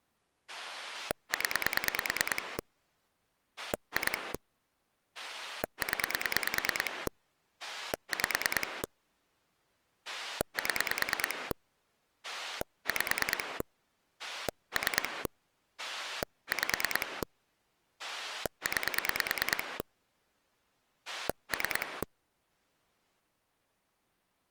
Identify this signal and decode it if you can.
Pulse dialling, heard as a rotary dial, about 9 pulses a second. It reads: 0 2 0 5 7 5 3 5 9 3